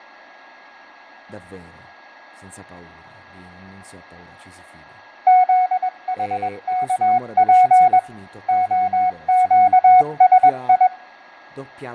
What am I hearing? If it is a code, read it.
Morse code, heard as a keyed tone, hand-sent with a paddle, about 21 wpm, 740 Hz, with fading, a steady whistle near 1650 Hz, room echo and speech in Italian. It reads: ZHKP OQSI